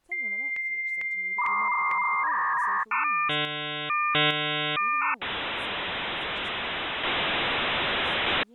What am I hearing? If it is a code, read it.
Dial-up modem handshake (V.34 or later), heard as a whistle, warbles, then hiss, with speech in English.